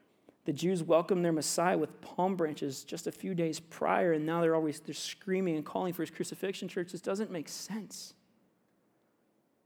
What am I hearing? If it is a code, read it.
Speech in English. There is no code.